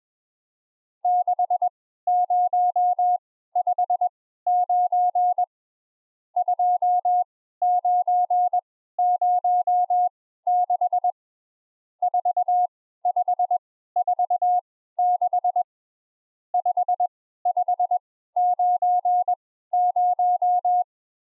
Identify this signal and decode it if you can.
Morse code, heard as a keyed tone, machine-sent, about 21 wpm, spaced as for 14 wpm, 720 Hz. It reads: 6059 2906 4546 5590